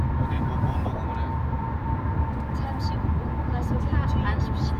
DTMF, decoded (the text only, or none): none